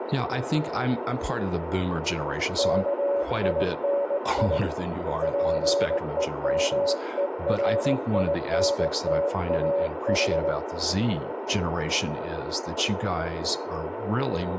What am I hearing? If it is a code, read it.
Morse code, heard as a keyed tone, hand-sent with a straight key, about 19 wpm, 560 Hz, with radio static, a narrow filter and speech in English. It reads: KINI PEMERINTAH